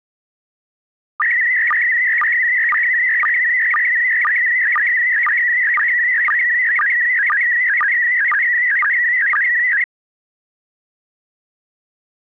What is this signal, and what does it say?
SSTV (slow-scan television), PD 120, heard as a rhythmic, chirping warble.